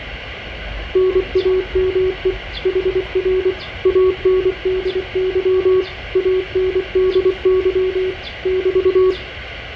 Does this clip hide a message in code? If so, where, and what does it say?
Yes: Morse code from 0.9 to 9.2 s, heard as a keyed tone, machine-sent, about 24 wpm, 370 Hz, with fading, room echo and the noise of a residential street. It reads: NAME HR ANDY ANDY <BT>